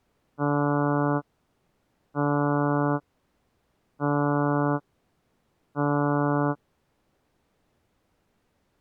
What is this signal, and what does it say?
Ship horn signal, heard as a ship's horn, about 140 Hz. 4 short. At sea: a pilot vessel's identity signal in fog.